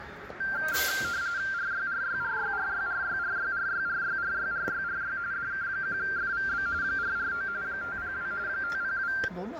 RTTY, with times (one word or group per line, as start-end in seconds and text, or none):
1.5-5.2 RYRYRYRYRYRYRYRYRYRYRY
5.3-6.7 DK1FVB
6.8-7.5 449
7.6-8.3 502
8.5-9.1 502